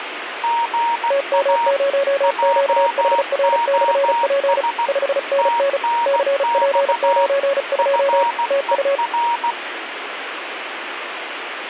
Morse code, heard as two keyed tones, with radio static. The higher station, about 16 wpm, 940 Hz: GA JOS TNX FER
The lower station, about 35 wpm, 560 Hz: TM0QHR/P 5NN CP92 TU